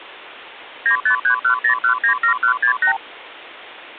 Multi-frequency trunk signalling (R2, with the far end's replies), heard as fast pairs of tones, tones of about 100 ms. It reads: 95310197168